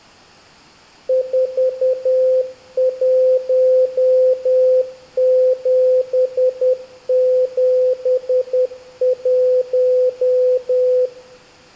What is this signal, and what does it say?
Morse code, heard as a keyed tone, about 10 wpm, 510 Hz, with room echo. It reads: 41771